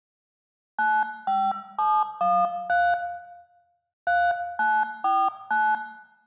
DTMF, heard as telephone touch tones, dialled by hand, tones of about 240 ms, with room echo. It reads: 95713 3949